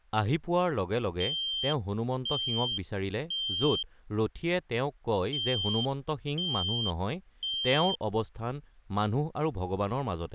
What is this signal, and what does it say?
Alarm pattern, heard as an alarm's beeps, played twice, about 3150 Hz, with speech in Assamese. Temporal three. Smoke or fire, evacuate.